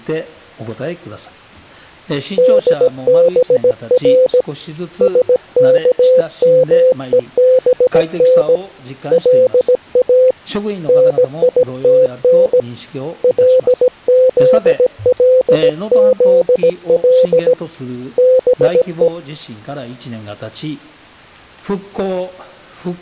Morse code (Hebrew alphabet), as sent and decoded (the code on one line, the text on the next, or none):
-.. -... .-. / ... -.- -- . -... -. / .-.. .- / -. .. - -. / .-.. --.. .-.. --.. .-.. / -... .
דבר שכמובן לא ניתן לזלזל בו